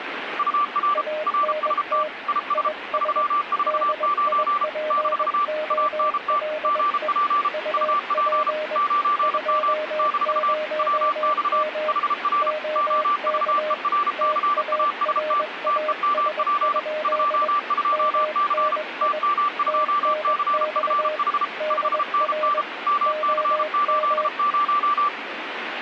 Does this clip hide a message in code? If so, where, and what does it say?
Yes: Morse code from 0.3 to 25.1 s, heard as two keyed tones, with radio static. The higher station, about 33 wpm, 1170 Hz: UR RST IS 349 - ANT GP UP 9M - WX HR OVERCAST TEMP 22C TM2CFH 5NN MC80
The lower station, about 21 wpm, 610 Hz: ANT IS DIPOLE UP 20M OK TARAS? MNI TNX DR OM